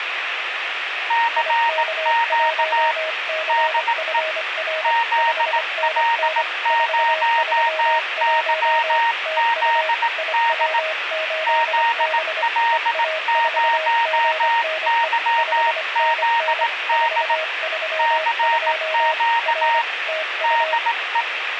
Morse code, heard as two keyed tones, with radio static and room echo. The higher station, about 18 wpm, 930 Hz: CQ DE ZL0YZD ZL0YZD CQ DE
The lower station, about 25 wpm, 630 Hz: IK1CFR 5NN 431 TU IW8B EA4GNE 5NN 432 R TU